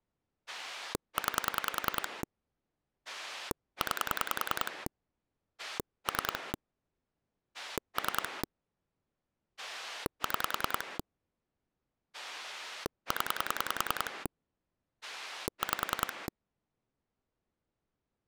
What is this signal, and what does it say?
Pulse dialling, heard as a rotary dial, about 10 pulses a second. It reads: 9 9 3 3 6 0 5